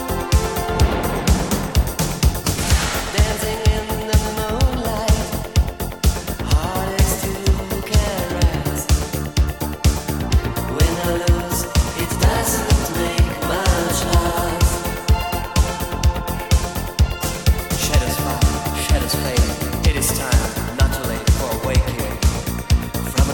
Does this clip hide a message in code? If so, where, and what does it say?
No.